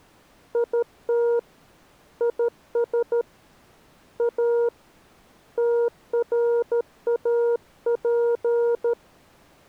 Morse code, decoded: IT IS A TRAP

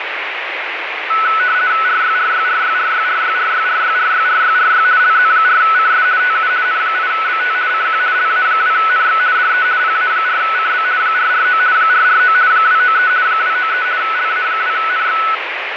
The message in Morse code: none

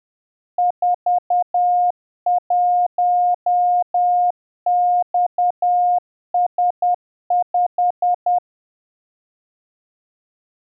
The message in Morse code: 41XS5

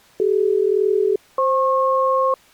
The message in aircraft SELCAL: CD-FP

